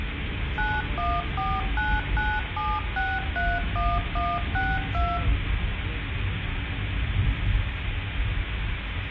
DTMF, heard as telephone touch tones, dialled by machine, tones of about 230 ms, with phone line noise, room echo and the noise inside a car. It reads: 914997631162